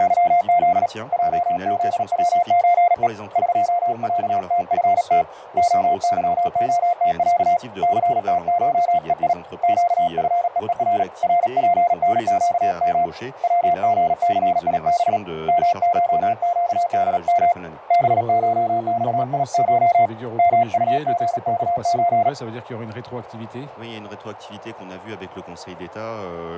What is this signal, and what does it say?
Morse code (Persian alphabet), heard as a keyed tone, hand-sent with a paddle, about 37 wpm, 700 Hz, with radio static. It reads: … جزوچه قصتفت عظعتص ثتشهی گفههر رپنگم وژثیب مشگدم بشخیش مطژکچ